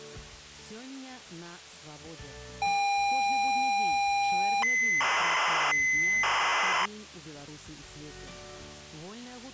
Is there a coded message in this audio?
Yes: ZX Spectrum tape loading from 2.6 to 6.9 s, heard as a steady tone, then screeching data.